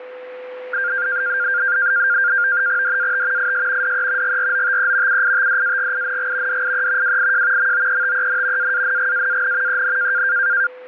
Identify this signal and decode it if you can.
NAVTEX (SITOR-B), 100 baud, 170 Hz shift, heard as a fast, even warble, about 1500 Hz centre, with a steady whistle near 500 Hz. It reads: DAT IS DE GROTE UITDAGING DIE WIJ MOETEN AANGAAN EN